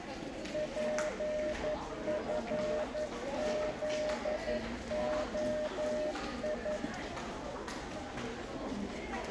Morse code, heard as a keyed tone, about 11 wpm, 610 Hz, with the noise of a crowd indoors. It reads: PFZOI